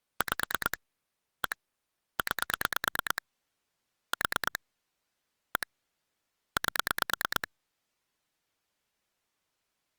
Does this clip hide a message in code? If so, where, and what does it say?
Yes: pulse dialling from 0.2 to 7.4 s, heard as clicks on a phone line, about 9 pulses a second. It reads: 5 1 9 4 1 8